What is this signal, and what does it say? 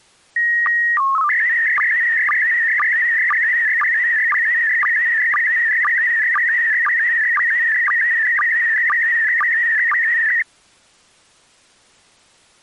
SSTV (slow-scan television), PD 120, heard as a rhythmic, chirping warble.